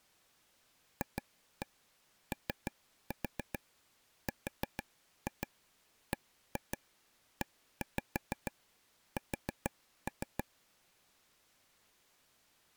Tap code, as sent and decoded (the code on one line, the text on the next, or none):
2-1 3-4 4-2 1-2 1-5 4-3
FORBES